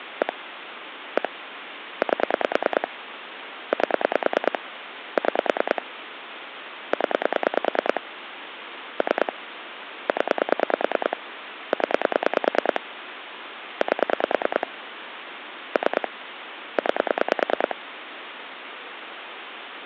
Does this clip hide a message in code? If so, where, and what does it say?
Yes: pulse dialling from 0.2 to 17.7 s, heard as clicks on a phone line, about 9 pulses a second, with phone line noise. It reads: 1 1 8 8 6 0 3 0 0 8 3 9